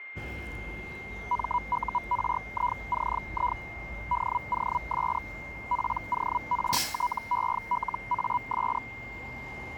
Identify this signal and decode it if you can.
Hellschreiber (Feld-Hell, 122.5 baud), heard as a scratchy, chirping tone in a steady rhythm, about 980 Hz, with a steady whistle near 2110 Hz and street noise. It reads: MURICI DOS PORTELAS